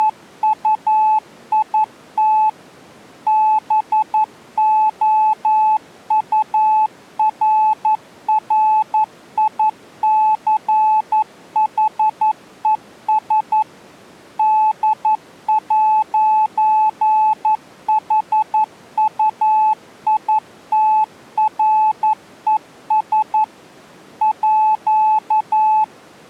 Morse code (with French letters), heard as a keyed tone, machine-sent, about 11 wpm, 860 Hz. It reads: … BOURRICHES D'HUITRES À